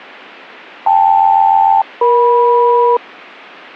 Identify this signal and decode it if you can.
Aircraft SELCAL, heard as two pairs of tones, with radio static. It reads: KL-EM